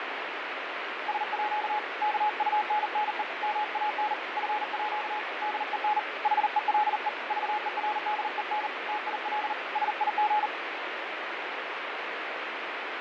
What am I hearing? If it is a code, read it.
Morse code (with Danish letters), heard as a keyed tone, hand-sent with a paddle, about 39 wpm, 840 Hz, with radio static and fading. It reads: SÅ KUNNE MAN FÅ DEN HELE VERDEN TIL SIG